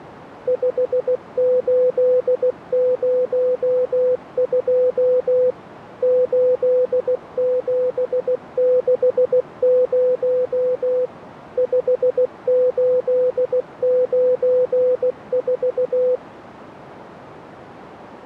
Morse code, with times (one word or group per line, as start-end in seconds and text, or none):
0.5-5.5 5802
6.0-11.1 8760
11.6-16.2 5894